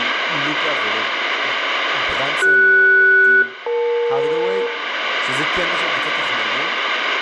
Aircraft SELCAL, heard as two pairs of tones, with radio static, room echo and speech in Hebrew. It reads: CS-EL